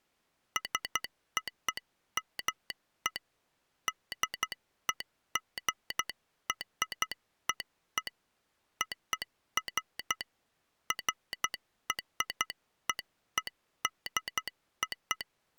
Morse code (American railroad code), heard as a telegraph sounder, hand-sent with a straight key. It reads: SOME DEGREE OF …